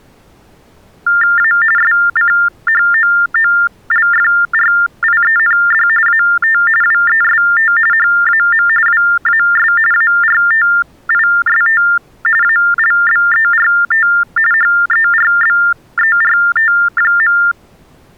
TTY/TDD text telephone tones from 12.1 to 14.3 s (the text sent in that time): ALBERT